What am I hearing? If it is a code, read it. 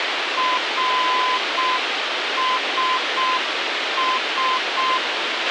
Morse code, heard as a keyed tone, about 6 wpm, 1020 Hz, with radio hiss and a squelch burst at the end. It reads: RSS